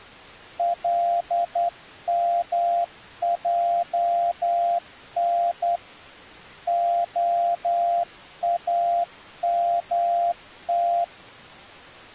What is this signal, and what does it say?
Morse code (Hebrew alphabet), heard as a keyed tone, hand-sent with a straight key, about 10 wpm, 690 Hz. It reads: למען האמת